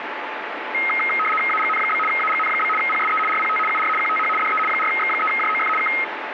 RTTY (75 baud, 850 Hz shift), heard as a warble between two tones, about 1700 Hz centre, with radio static. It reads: AGN? AGN? PSE RPT UR QTH DE 4X3JOF K